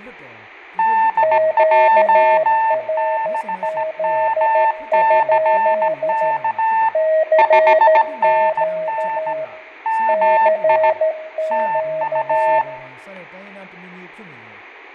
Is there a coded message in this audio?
Yes: Morse code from 0.7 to 12.7 s, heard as two keyed tones, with fading and room echo. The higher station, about 17 wpm, 890 Hz: DJ6MCK 5NN MI TU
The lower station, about 13 wpm, 630 Hz: QRZ? CQ CQ